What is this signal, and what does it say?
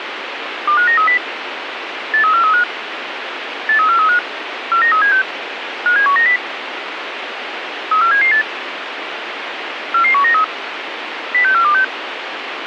Five-tone selective call (CCIR), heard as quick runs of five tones, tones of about 100 ms, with radio hiss. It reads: 25930 83435 83435 49376 57190 34778 44193 06426